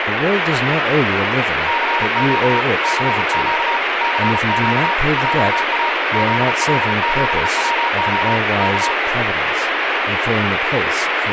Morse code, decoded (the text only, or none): CQ CQ CQ JA ZL7WO K